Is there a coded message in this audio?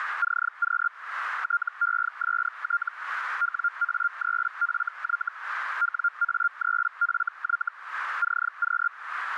Yes: Hellschreiber (Feld-Hell, 122.5 baud) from 0.2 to 8.9 s, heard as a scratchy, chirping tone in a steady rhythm, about 1400 Hz, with radio static. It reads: CQ TEST WA3FY WA3FY CQ